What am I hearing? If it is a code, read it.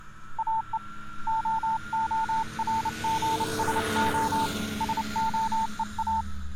Morse code (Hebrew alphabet), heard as a keyed tone, hand-sent with a paddle, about 29 wpm, 890 Hz. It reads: או ההרגשה שהוא